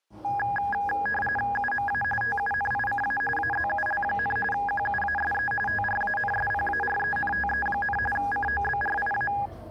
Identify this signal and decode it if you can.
RTTY (45.45 baud, 850 Hz shift), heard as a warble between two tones, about 1240 Hz centre, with the noise of a crowd indoors. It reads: UMA TUNICA AZUL, QUASE TRANSPARENTE, COBRIA